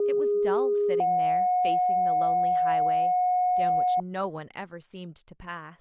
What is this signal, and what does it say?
Two-tone page, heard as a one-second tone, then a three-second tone, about 410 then 730 Hz, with speech in English.